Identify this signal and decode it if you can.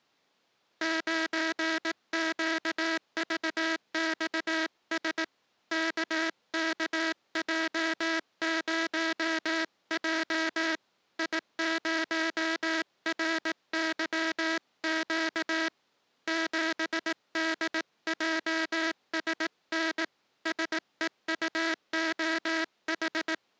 Morse code, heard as a buzzer, hand-sent with a paddle, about 18 wpm. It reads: 9QVXS KKJ0J I0RYQ 7DJSN SEUOH